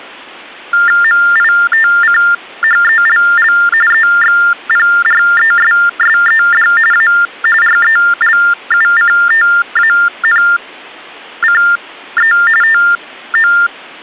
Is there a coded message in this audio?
Yes: TTY/TDD text telephone tones (45.45 baud Baudot) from 0.7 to 13.7 s, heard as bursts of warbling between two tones, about 400 Hz shift, 1600 Hz centre. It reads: MITCHELL EXPRESSED A RELUCTANCE TO